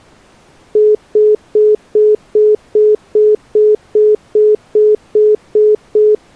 Telephone call progress tone (single-tone plan, as in most of Europe), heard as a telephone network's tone, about 420 Hz, 0.2 s on and 0.2 s off. Congestion tone.